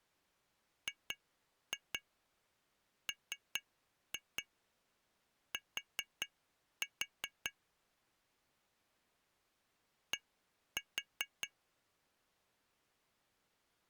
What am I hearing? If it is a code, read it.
Tap code, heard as taps on glass, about 4 knocks a second. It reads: GMT D